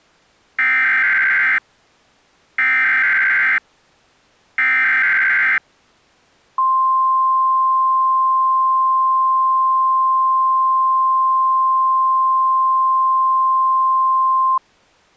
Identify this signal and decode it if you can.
Emergency Alert System (SAME) tones (header bursts, then the 1050 Hz attention tone), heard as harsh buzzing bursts, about 520.83 baud.